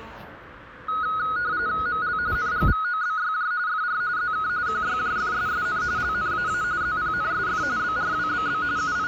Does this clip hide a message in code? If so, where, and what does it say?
Yes: RTTY (45.45 baud, 170 Hz shift) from 0.9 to 9.1 s, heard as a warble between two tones, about 1360 Hz centre, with radio static and the noise of a subway station. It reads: ML NGVOBYJ FR ZK QYJFSSN LNAA ZPNSF BRWBB …